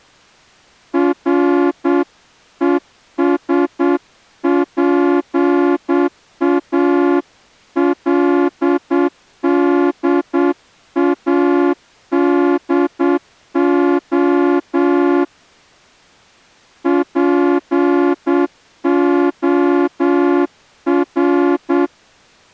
Morse code, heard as a horn, hand-sent with a straight key, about 8 wpm. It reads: RESPALDADO POR